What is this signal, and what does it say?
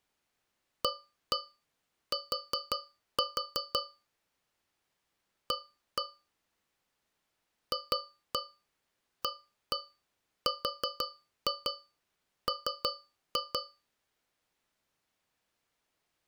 Tap code, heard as taps on a metal pipe, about 5 knocks a second. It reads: AT A FARM